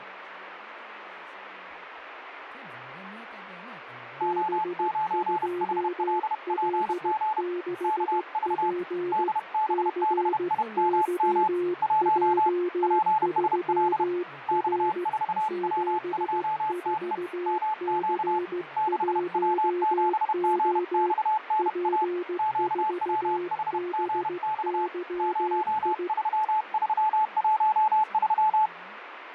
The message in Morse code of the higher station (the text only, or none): O9HLPG KV DBBIMM 1 PSL X4W2TE MQ 6W7GXNA QWHGX 03313